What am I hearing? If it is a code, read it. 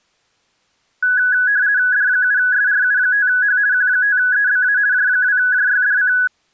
RTTY (50 baud, 170 Hz shift), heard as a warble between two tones, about 1600 Hz centre. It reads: D7SRU5H Q5EBA J2JYDC